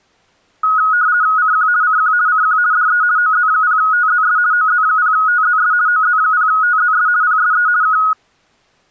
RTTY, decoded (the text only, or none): CQ CQ CQ DE OZ0TZS OZ0TZS OZ0TZS PSE K